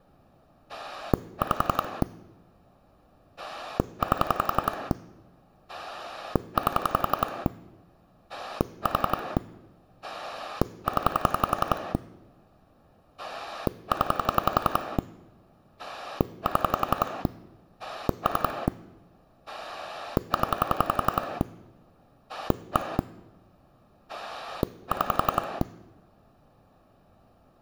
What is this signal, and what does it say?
Pulse dialling, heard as a rotary dial, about 11 pulses a second. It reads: 5 8 8 4 0 0 7 3 0 1 6